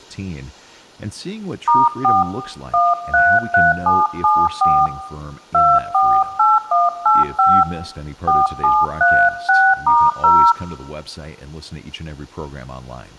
DTMF, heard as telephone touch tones, dialled by hand, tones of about 230 ms, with room echo and speech in English. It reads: *4 133774 248185 4736*0